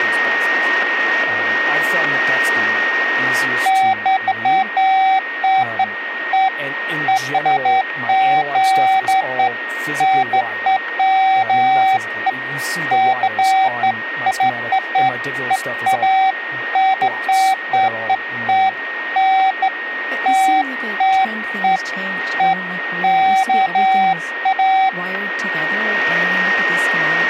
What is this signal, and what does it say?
Beeps of irregular length, with a steady whistle near 1860 Hz and speech in English. There is no code.